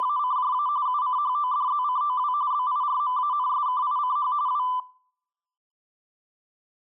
RTTY (45.45 baud, 170 Hz shift), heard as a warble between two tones, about 1090 Hz centre, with room echo. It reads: … UCHODZCOW BIRMANSKICH W